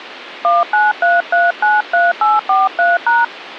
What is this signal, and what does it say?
DTMF, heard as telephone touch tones, dialled by hand, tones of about 180 ms. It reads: 193393843#